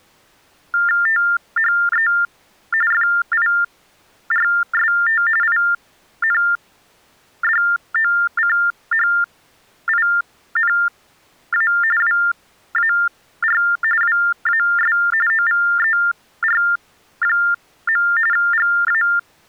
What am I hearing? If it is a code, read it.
TTY/TDD text telephone tones (45.45 baud Baudot), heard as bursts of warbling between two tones, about 400 Hz shift, 1600 Hz centre. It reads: THE FIRST INDOCHINA WAR WAS OVER. GA